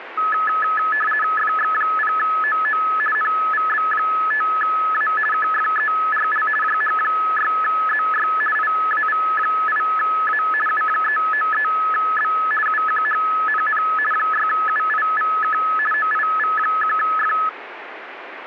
RTTY (50 baud, 450 Hz shift), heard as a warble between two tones, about 1500 Hz centre, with radio static. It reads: FX0OO NVB5A KFERL JH6ZY IAV8A U393B UQHNN 6UIVK OIV1F